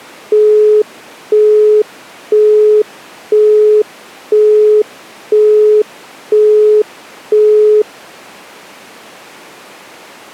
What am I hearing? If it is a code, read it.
Telephone call progress tone (single-tone plan, as in Europe, Japan and elsewhere), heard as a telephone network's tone, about 420 Hz, 0.5 s on and 0.5 s off. Busy tone.